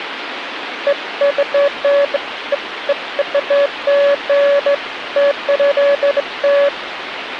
Beeps of irregular length, with phone line noise. There is no code.